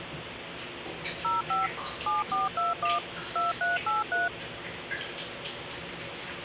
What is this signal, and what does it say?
DTMF, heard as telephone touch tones, dialled by machine, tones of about 160 ms, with phone line noise and the noise of a restroom. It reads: 05 7421 2383